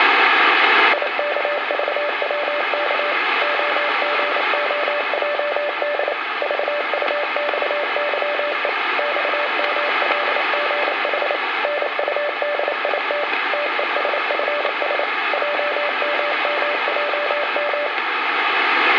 Morse code, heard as a keyed tone, machine-sent, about 28 wpm, 590 Hz, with radio static. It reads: IKVWK OGOJD VUXYE XMLGH NUDIT TESFS JMMJM